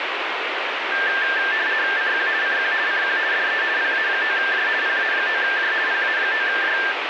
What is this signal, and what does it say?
RTTY (50 baud, 170 Hz shift), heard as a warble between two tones, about 1700 Hz centre, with radio static. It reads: CQ CQ CQ DE PA9J PA9J PA9J